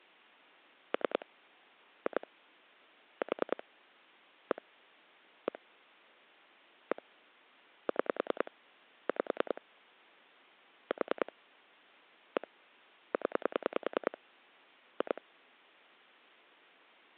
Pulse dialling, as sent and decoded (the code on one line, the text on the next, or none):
3 / 2 / 4 / 1 / 1 / 1 / 6 / 5 / 4 / 1 / 10 / 2
3 2 4 1 1 1 6 5 4 1 0 2